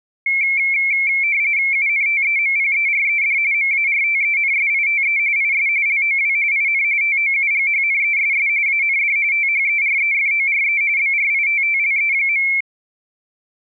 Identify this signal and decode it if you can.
RTTY (45.45 baud, 170 Hz shift), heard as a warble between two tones, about 2250 Hz centre. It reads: UNTEMPERED MARTENSITE IS LOW IN TOUGHNESS AND THEREFORE BRITTLE.